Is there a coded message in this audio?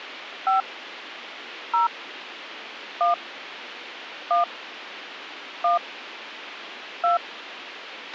Yes: DTMF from 0.5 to 7.2 s, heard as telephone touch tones, dialled by hand, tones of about 140 ms, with radio hiss and a squelch burst at the end. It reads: 5 0 1 1 1 2